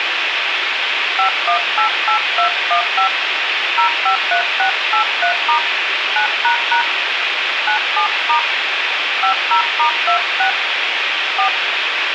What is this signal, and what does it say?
DTMF, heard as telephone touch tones, dialled by hand, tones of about 100 ms, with phone line noise. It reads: 5188215 053683* 9## 97* 50*26 4